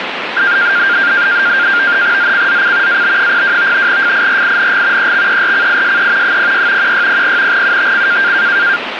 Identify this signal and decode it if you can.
NAVTEX (SITOR-B), 100 baud, 170 Hz shift, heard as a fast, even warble, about 1500 Hz centre, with radio static. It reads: ZCZC AB02 FIRING EXERCISE 06 1600 UTC